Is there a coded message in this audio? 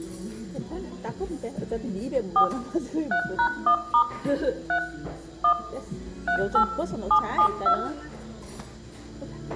Yes: DTMF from 2.4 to 7.7 s, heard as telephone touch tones, dialled by machine, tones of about 90 ms, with room echo and the noise of a restaurant. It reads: 4 3#1* 3 1 38 772